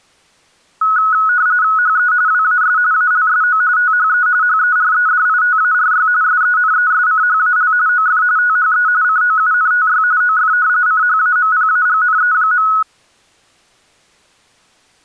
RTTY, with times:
1.8-2.1 HE
2.3-2.8 WAS
2.9-3.6 ALSO
3.8-4.3 THE
4.4-6.1 HEREDITARY
6.2-7.7 SENESCHAL
7.9-8.2 OF
8.4-8.9 THE
9.0-10.0 COUNTY
10.2-10.5 OF
10.9-12.7 CHAMPAGNE.

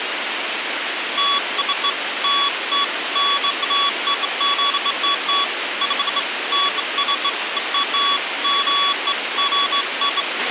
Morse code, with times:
none

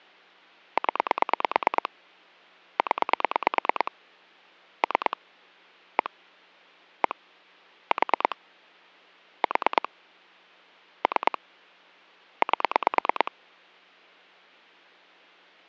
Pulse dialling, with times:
0.8-1.9 0
2.8-3.9 0
4.8-5.2 3
6.0-6.1 1
7.0-7.2 1
7.9-8.4 4
9.4-9.9 4
11.0-11.4 3
12.4-13.3 8

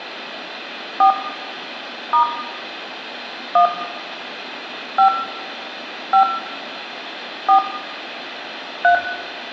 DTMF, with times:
1.0-1.1 4
2.1-2.2 *
3.6-3.7 1
5.0-5.1 5
6.1-6.2 5
7.5-7.6 4
8.8-8.9 3

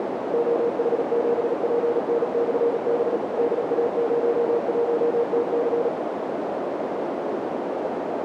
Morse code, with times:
0.3-3.2 OH7PN/B
3.4-5.9 DA01TC

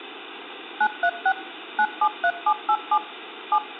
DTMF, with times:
0.8-1.3 936
1.8-3.0 973787
3.5-3.6 7

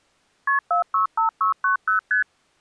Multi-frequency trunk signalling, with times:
0.5-0.6 KP
0.7-2.0 465690
2.1-2.2 ST

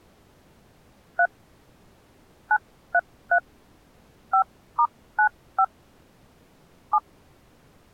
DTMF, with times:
1.2-1.3 3
2.5-3.4 933
4.3-5.6 5*95
6.9-7.0 7

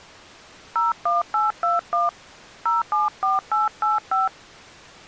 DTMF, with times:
0.8-2.1 01821
2.7-4.3 074885

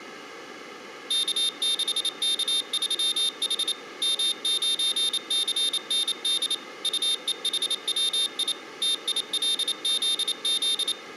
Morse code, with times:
1.1-3.7 K6K3H
4.0-6.5 M9CND
6.8-8.5 UEHWI
8.8-10.9 TILZZ

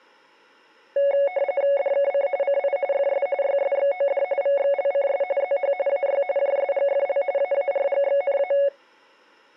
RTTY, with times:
1.8-2.3 DKC
2.4-2.8 CI
2.9-3.3 FS
3.4-4.2 YSXOD
4.4-5.2 VXLCS
5.4-5.7 ZH
5.9-6.2 AY
6.4-7.2 JSGFL
7.4-8.5 AARGXNA

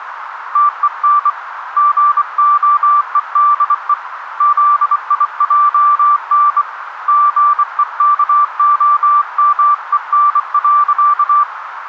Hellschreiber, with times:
none

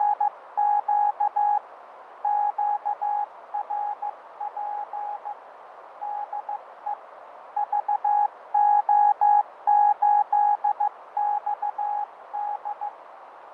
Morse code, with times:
0.0-1.6 …
2.2-5.3 QRP
6.0-6.9 DE
7.6-12.9 VO8XD

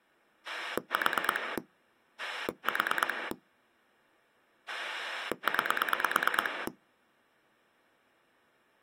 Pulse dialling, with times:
0.5-1.6 4
2.2-3.3 4
4.7-6.7 9

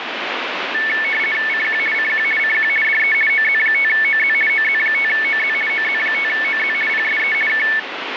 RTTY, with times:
1.5-1.8 CQ
1.9-2.2 CQ
2.4-2.7 CQ
2.8-3.1 DE
3.3-4.3 OZ5OZ
4.5-5.5 OZ5OZ
5.7-6.7 OZ5OZ
6.9-7.3 PSE
7.5-7.6 K

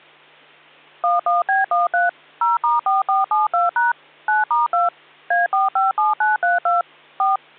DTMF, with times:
1.0-2.1 11B13
2.4-3.9 0*4472#
4.3-4.9 9*2
5.3-6.8 A457932
7.2-7.4 4

